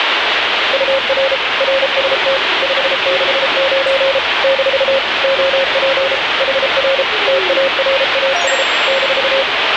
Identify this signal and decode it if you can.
Morse code, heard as a keyed tone, machine-sent, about 33 wpm, 540 Hz, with radio static and the noise of a subway station. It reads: UR RST 569 - OP HR TARAS -